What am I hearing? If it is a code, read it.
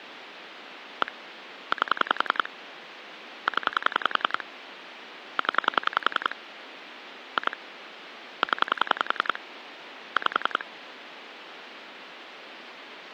Pulse dialling, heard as clicks on a phone line, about 10 pulses a second, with phone line noise. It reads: 1 8 0 0 2 0 5